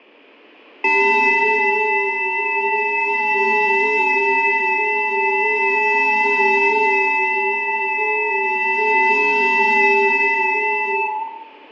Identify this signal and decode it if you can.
FT8 (several signals at once), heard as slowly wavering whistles, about 6.25 baud, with room echo.